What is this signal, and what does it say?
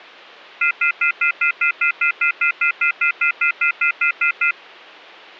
Telephone call progress tone (North American plan), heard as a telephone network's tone, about 1400, 2050, 2450, 2600 Hz, 0.1 s on and 0.1 s off. Off-hook warning tone.